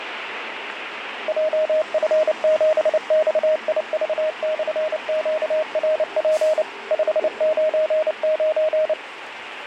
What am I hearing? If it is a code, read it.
Morse code, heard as a keyed tone, machine-sent, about 29 wpm, 620 Hz, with radio static and street noise. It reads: JF7XIV/QRP 599